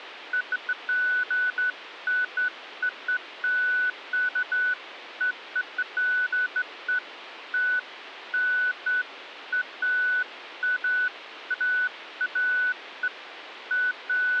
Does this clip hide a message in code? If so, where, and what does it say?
No, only beeps of irregular length.